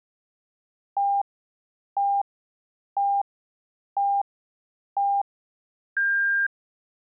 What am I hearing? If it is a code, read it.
Radio time signal (five pips and a higher one, as on Chinese radio), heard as pips.